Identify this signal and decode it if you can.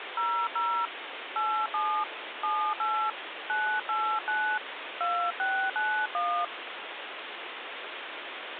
DTMF, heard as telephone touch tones, dialled by hand, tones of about 300 ms, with phone line noise. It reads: 00 87 78 989 2691